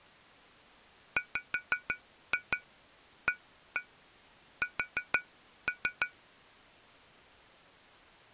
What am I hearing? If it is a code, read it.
Tap code, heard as taps on glass, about 6 knocks a second. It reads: WAS